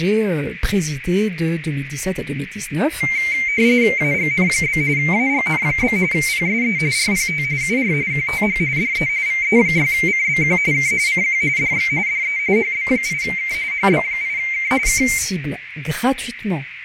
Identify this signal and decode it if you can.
RTTY (45.45 baud, 170 Hz shift), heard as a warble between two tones, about 2200 Hz centre, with radio static, a narrow filter and speech in French. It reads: AGN? AGN? PSE RPT UR QTH DE VE6CBQ K CQ DX DE HB8K HB8K K